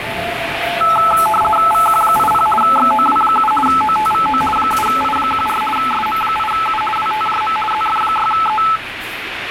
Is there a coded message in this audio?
Yes: RTTY (50 baud, 450 Hz shift) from 0.8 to 8.8 s, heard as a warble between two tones, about 1090 Hz centre, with radio static and the noise of a subway station. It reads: VQ80 XOW7 OTVO 7I14 SM8U WTJM ZF6E